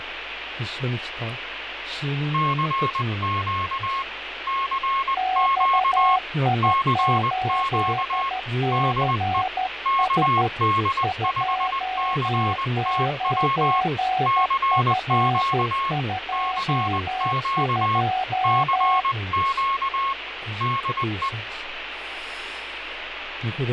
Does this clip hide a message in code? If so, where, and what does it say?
Yes: Morse code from 2.3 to 21.3 s, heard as two keyed tones, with radio static and fading. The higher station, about 20 wpm, 1090 Hz: CQ CQ CQ DE KD5CTW CQ CQ CQ DE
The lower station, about 13 wpm, 750 Hz: XI8CS 29F22